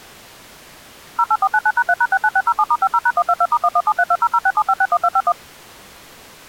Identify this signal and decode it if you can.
DTMF, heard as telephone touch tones, dialled by machine, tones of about 50 ms. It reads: 08499#3#69607*50#122*117320067561251